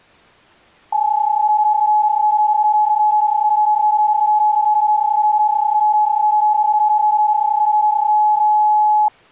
PSK31 (31.25 baud), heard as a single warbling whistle, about 850 Hz.